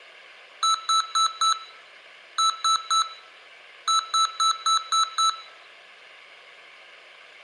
Beep code, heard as beeps from a small speaker, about 1320 Hz, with room echo. 4-3-6.